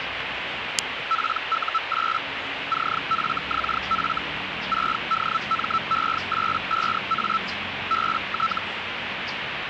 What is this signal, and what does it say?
Hellschreiber (Feld-Hell, 122.5 baud), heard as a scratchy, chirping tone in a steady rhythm, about 1320 Hz, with radio static and the noise of a residential street. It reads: PU8 CFXF 6DME85A BT